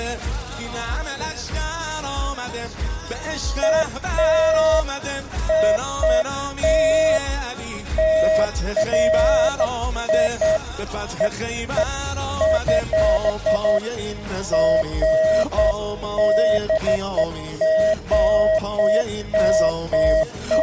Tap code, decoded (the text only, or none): none